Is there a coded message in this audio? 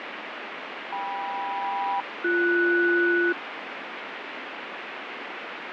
Yes: aircraft SELCAL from 0.9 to 3.3 s, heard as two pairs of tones, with heavy radio static and fading. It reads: KM-BS